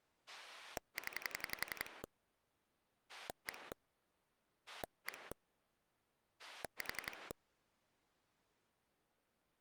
Pulse dialling, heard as a rotary dial, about 11 pulses a second. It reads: 0 1 1 4